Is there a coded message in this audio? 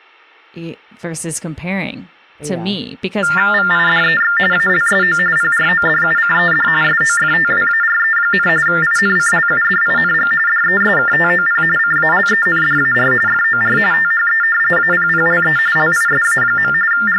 Yes: TTY/TDD text telephone tones (45.45 baud Baudot) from 3.2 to 17.2 s, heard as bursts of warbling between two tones, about 400 Hz shift, 1600 Hz centre, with speech in English. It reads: VIDEX ALSO PRODUCED SOFTWARE, INCLUDING DESKTOP CALENDAR FOR THE APPLE LISA. …